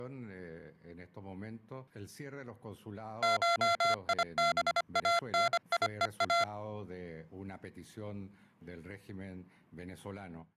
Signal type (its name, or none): Morse code